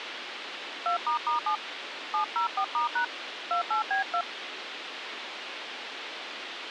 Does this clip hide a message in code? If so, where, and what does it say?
Yes: DTMF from 0.9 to 4.2 s, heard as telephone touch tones, dialled by hand, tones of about 100 ms, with radio hiss. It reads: 2**7 704*# 28B2